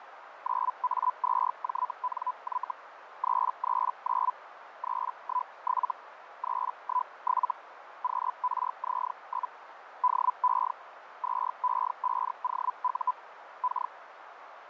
Hellschreiber (Feld-Hell, 122.5 baud), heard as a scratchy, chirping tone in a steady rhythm, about 1000 Hz, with radio static and a narrow filter. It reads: 9A2JNY 339 317 317 QRZ? DE 2E5OU K